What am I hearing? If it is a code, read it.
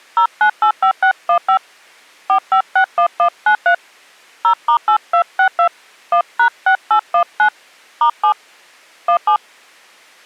DTMF, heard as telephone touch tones, dialled by hand, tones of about 90 ms. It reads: 0985615 4561193 0*8262 1#6819 *7 17